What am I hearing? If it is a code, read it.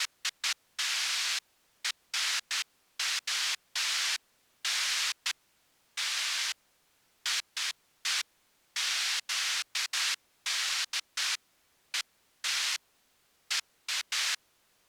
Bursts of noise. There is no code.